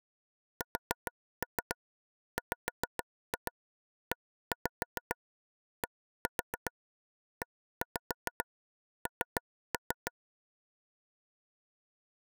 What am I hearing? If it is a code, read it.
Tap code, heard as taps on a table, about 7 knocks a second. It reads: SWEDEN